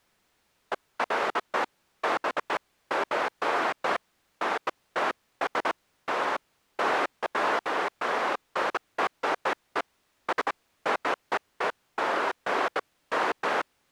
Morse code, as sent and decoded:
none

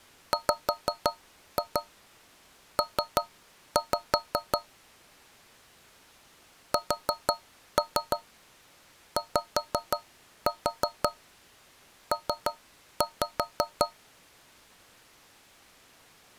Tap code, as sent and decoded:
5-2 3-5 / 4-3 5-4 3-5
WP SYP

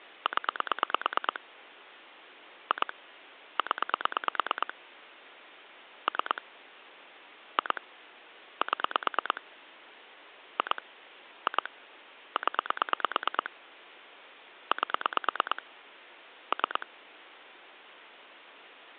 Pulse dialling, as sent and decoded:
10 / 2 / 10 / 3 / 2 / 7 / 2 / 2 / 10 / 8 / 3
0 2 0 3 2 7 2 2 0 8 3

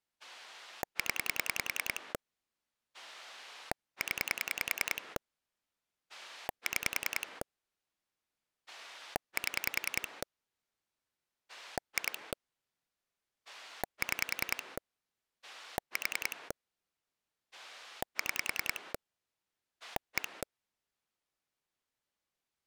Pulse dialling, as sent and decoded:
10 / 10 / 6 / 7 / 2 / 6 / 4 / 6 / 1
0 0 6 7 2 6 4 6 1

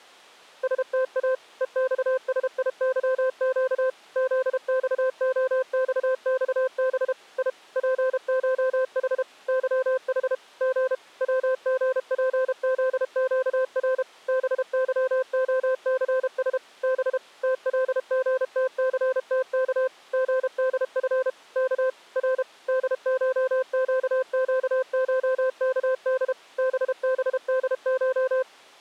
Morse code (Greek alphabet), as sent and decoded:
... - .- / . -..- ... .. -.-- --.- / --.. -..- --- -..- -..- -... / .. / .--. ---- .... / -.-- .... / --. / .-- --. .--. --.. --.- .-. / -... -.-- --- -.-. ... / -... / - .-.. --. - -.-. - -.- / --. -.. ..-. / -.- / .-. / -.. ---- --.- --.- ---- -.- -.. / -... -... -.. ----
ΣΤΑ ΕΞΣΙΥΨ ΖΞΟΞΞΒ Ι ΠΧΗ ΥΗ Γ ΩΓΠΖΨΡ ΒΥΟΘΣ Β ΤΛΓΤΘΤΚ ΓΔΦ Κ Ρ ΔΧΨΨΧΚΔ ΒΒΔΧ

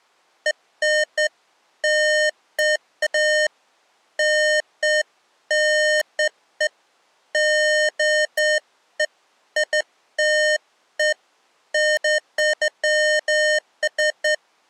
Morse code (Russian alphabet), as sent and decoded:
none

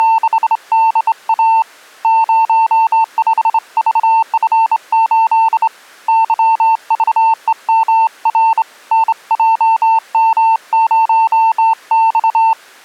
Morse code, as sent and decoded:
… / ----- ..... ...- ..-. ---.. / -.-- ...- . -- .-. / -. .--- -- ----- -..-
… 05VF8 YVEMR NJM0X

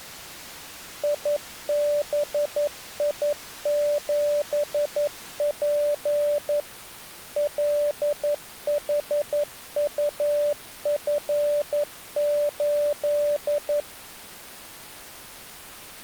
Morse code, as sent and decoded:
.. -... .. --... .--. / .-.. .... ..- ..-. ---..
IBI7P LHUF8

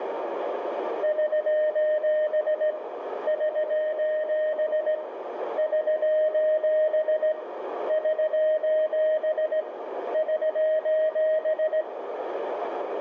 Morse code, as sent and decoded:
...---... / ...---... / ...---... / ...---... / ...---...
<SOS> <SOS> <SOS> <SOS> <SOS>

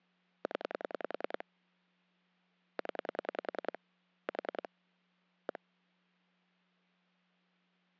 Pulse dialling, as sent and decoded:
10 / 10 / 4 / 1
0 0 4 1

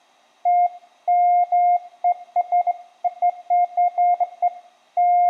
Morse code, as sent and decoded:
none

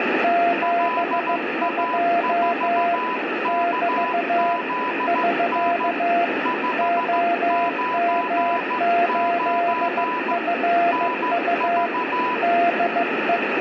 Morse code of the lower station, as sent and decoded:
--... ..--- / -...- / ...-.- / --- -- ---.. ..-. ..- / -.. .
72 <BT> <SK> OM8FU DE

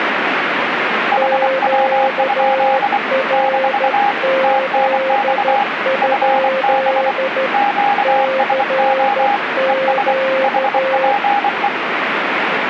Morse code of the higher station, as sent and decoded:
.... .-- ..--.. / -....- / - -. -..- / ..-. -... / --.- ... --- / . ... / .... .--. .
HW? - TNX FB QSO ES HPE

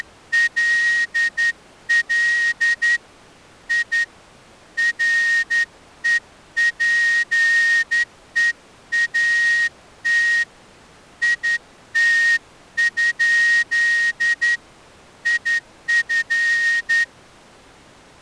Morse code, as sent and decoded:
… / .. / .-. . .--. . .- - / .. - ..--.. / .. ..-.
… I REPEAT IT? IF

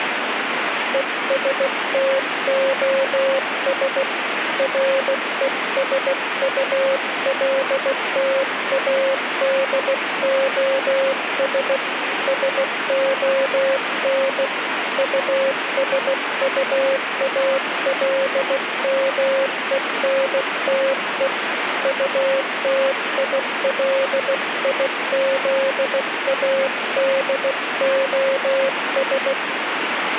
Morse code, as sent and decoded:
. ... - --- ... / .-. . ... ..- .-.. - .- -.. --- ... / ... --- -. / ..- ... ..- .- .-.. -- . -. - . / ..- - .. .-.. .. --.. .- -.. --- ...
ESTOS RESULTADOS SON USUALMENTE UTILIZADOS

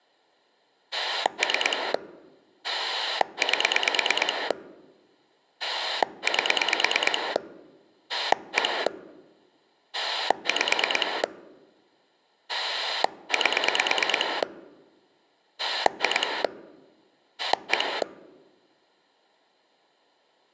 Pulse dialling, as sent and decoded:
3 / 8 / 8 / 1 / 5 / 8 / 2 / 1
3 8 8 1 5 8 2 1

